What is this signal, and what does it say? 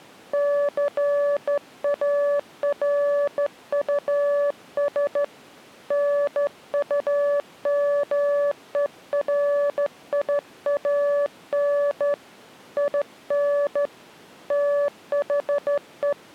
Morse code, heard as a keyed tone, hand-sent with a straight key, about 13 wpm, 580 Hz. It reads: CARUS NUMERIAN IN THE